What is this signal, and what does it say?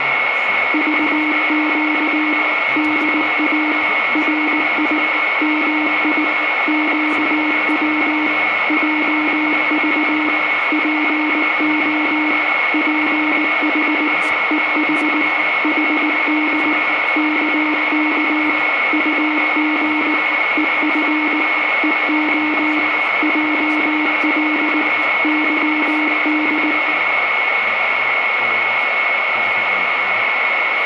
Morse code, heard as a keyed tone, machine-sent, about 19 wpm, 300 Hz, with radio static, a steady whistle near 2190 Hz, room echo and speech in English. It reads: VQ DA RI MI QW JV PO PH EH HD KK UG EF EO JL YD